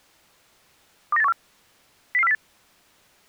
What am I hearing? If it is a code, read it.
Five-tone selective call (EEA), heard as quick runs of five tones, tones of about 40 ms. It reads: 29814 00408